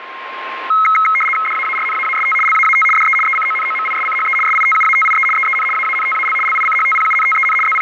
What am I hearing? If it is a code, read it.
RTTY (75 baud, 850 Hz shift), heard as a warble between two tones, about 1700 Hz centre, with radio static and a steady whistle near 1060 Hz. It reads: DAARNAAST LAAT DE ECONOMISCHE SITUATIE EEN AANTAL LICHTPUNTEN …